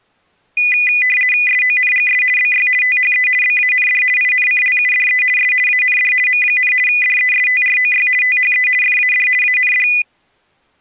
RTTY (50 baud, 450 Hz shift), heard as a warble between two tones, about 2250 Hz centre. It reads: SONGS BY THE BAND INCLUDE S AND M, DESTROY THE FAD AND